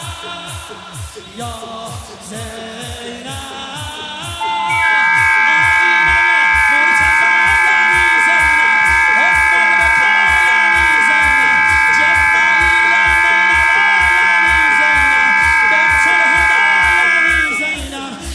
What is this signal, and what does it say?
FT8 (several signals at once), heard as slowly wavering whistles, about 6.25 baud.